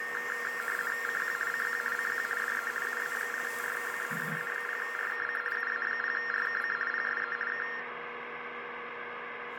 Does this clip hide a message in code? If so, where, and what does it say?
Yes: RTTY (50 baud, 450 Hz shift) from 0.0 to 7.8 s, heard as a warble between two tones, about 1600 Hz centre, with radio static, a steady whistle near 480 Hz and the noise of a restroom. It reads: CQ CQ CQ DE UA0RKC UA0RKC UA0RKC PSE K